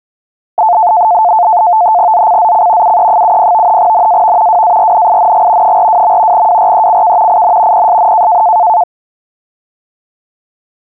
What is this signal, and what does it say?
NAVTEX (SITOR-B), 100 baud, 170 Hz shift, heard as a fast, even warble, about 790 Hz centre. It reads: ZCZC UE70 NAV WARNING 42. WRECK IN PSN